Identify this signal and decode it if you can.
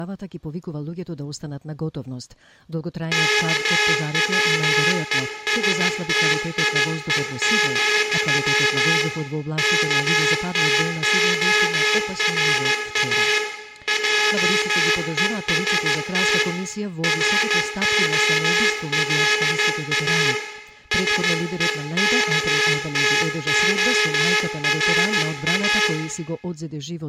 Morse code, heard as a buzzer, hand-sent with a straight key, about 14 wpm, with room echo. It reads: KWESTIE, KTORA JEST ROLA SEKTORA